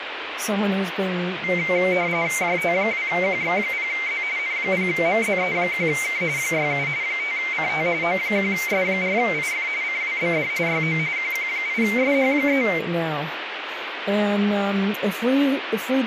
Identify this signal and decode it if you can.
RTTY (45.45 baud, 170 Hz shift), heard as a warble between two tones, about 2200 Hz centre, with radio static and speech in English. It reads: JT2QX0Z N0MZE1K 67 5CT O1S4IF CWBD YO QQ8SH3